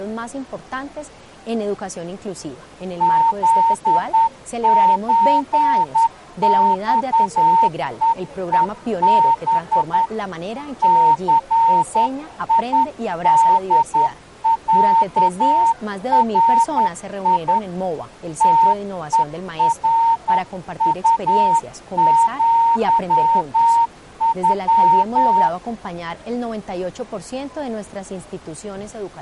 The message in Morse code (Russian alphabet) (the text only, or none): ЗЧЬЕЕБ ЦИДЯРИ ТЕРУЪЮ